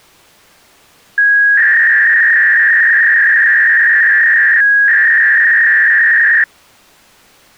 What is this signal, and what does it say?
300-baud modem data (V.21 tones), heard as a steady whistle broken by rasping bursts, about 300 baud, 200 Hz shift.